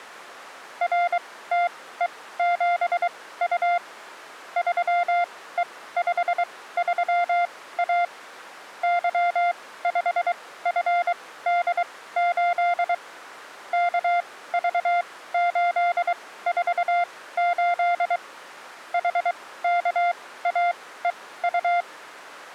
Morse code, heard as a keyed tone, machine-sent, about 23 wpm, spaced as for 16 wpm, 700 Hz. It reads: RTE7U 3E53A Y5FD8 KV848 HKAEU